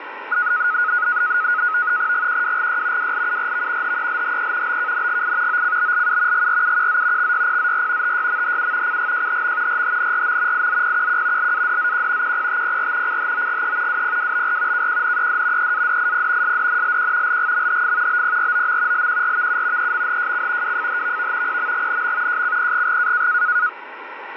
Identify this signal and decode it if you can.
NAVTEX (SITOR-B), 100 baud, 170 Hz shift, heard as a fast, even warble, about 1360 Hz centre, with radio static. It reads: GQWGY WLURV HELHE BKNGI OCBLU GRUQZ XYPZR TYMHU CGJHM RHNRM IZPQQ LADZQ QPTPR CHOGE WPWBR KQNED EADIP SDNLQ LGMHF BPROM LQRVU EMHJC WFHVV PMGNM JCPGG